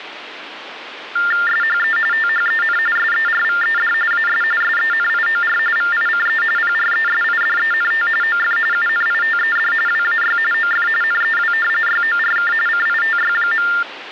TTY/TDD text telephone tones (45.45 baud Baudot), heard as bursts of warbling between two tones, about 400 Hz shift, 1600 Hz centre, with phone line noise. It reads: SHE THEN SERVED AS SENIOR VICE PRESIDENT OF UNITED WAY OF NEW YORK CITY.